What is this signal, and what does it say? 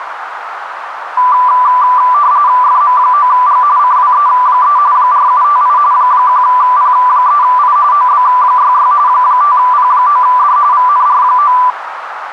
RTTY (45.45 baud, 170 Hz shift), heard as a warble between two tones, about 1080 Hz centre, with radio static and a narrow filter. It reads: FM9G CWE3 4758 1P3I OB66 5P9D VNR9